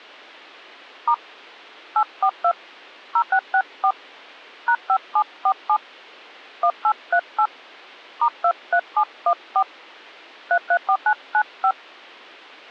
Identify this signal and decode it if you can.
DTMF, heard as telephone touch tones, dialled by hand, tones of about 70 ms. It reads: * 842 0664 #5747 1838 *23714 334995